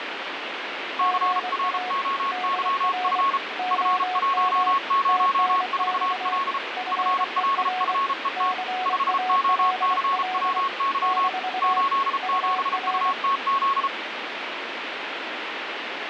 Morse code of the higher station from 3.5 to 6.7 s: F104L

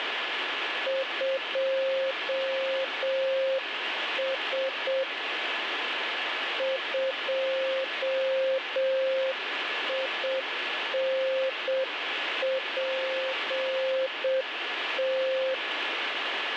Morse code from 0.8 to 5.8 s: 2S

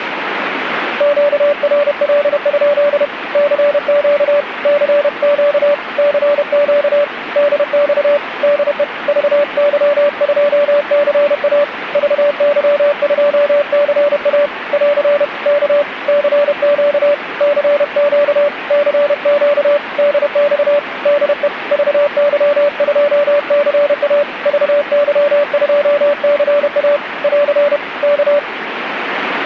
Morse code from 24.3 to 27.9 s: VY2CA <AR>

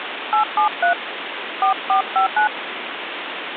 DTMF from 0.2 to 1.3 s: 873

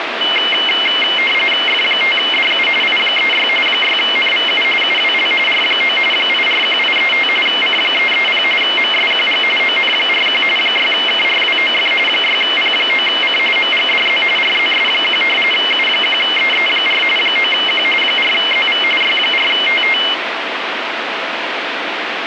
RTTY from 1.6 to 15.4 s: F5DU I36 6NVU UWL R9 841835 C330 MSQG ON41 6KRWOF 6P9C MGDZ RZS1

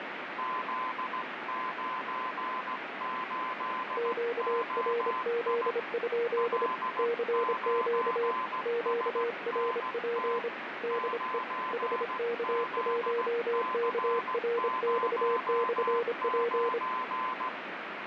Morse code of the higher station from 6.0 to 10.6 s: L9SNT

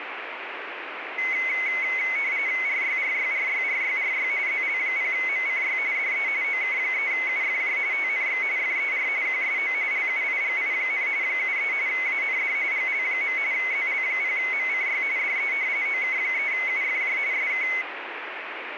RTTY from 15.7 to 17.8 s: OK3UFJ SK

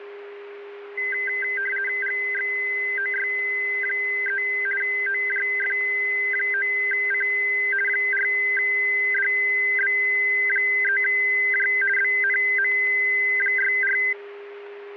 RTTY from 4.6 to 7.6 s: OJF9C

